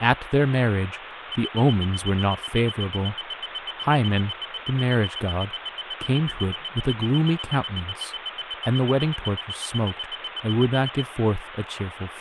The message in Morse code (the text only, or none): none